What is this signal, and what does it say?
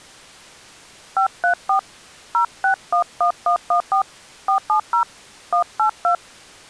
DTMF, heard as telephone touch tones, dialled by hand, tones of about 100 ms. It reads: 534 0611114 470 182